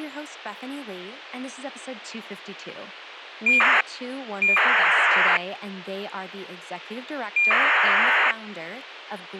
ACARS aircraft data, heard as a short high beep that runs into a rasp, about 2400 baud, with radio hiss and speech in English.